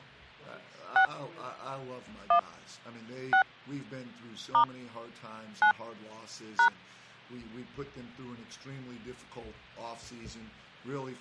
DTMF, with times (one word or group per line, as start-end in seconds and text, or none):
1.0-1.0 6
2.3-2.4 1
3.3-3.4 6
4.5-4.6 *
5.6-5.7 9
6.6-6.7 #